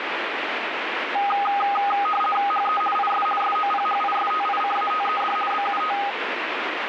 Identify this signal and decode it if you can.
RTTY (50 baud, 450 Hz shift), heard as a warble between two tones, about 1030 Hz centre, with radio static. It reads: HE IS SOPHISTICATED BUT